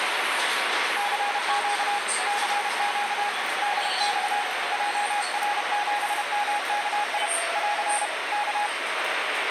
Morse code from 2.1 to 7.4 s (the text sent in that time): CQ DX JR7MKI